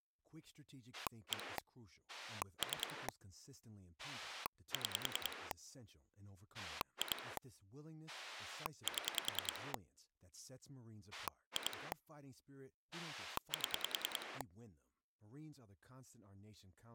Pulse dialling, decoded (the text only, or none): 1 3 6 2 7 2 7